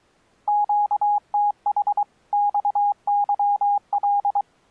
Morse code, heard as a keyed tone, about 23 wpm, 820 Hz. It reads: QTH XYL